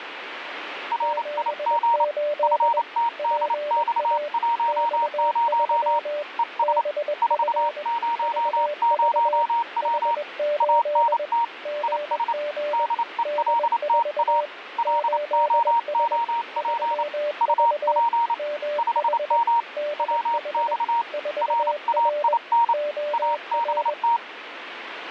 Morse code, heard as two keyed tones, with radio static. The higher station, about 28 wpm, 930 Hz: RIG FTDX10 ES 400W ANT IS DELTA LOOP UP 5M WX RAIN ABT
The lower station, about 21 wpm, 590 Hz: 78 PA X3 BF VV H8 GG D4 8S 3V MH DH 4R OR